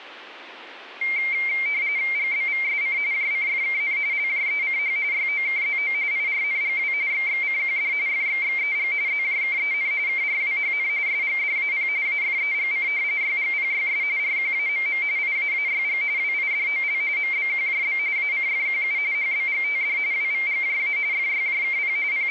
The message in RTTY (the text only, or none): GBVSC JCFKN LJECH YOKZO IRNGW XXCQD FXXEG ZJKEN KRWHN SGDAP AFEGC YGPYS RQAMM IAAYG WIDOL MBQJB ACFQU HBGTD WVGJA FYJKP …